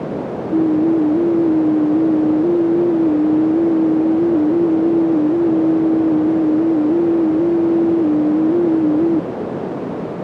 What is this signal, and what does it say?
FT8 (one signal), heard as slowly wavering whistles, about 6.25 baud, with heavy radio static and a narrow filter.